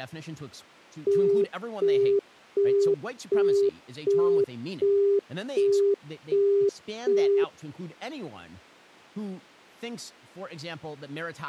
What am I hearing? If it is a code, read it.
Telephone call progress tone (as in the UK, Australia and similar networks), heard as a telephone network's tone, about 400 Hz, 0.375 s on and 0.375 s off, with speech in English. Busy tone.